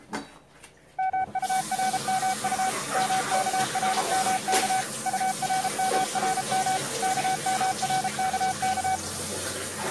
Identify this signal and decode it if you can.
Morse code, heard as a keyed tone, machine-sent, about 33 wpm, 760 Hz, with kitchen noise. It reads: MURMU MKRMK URMRM KMRKK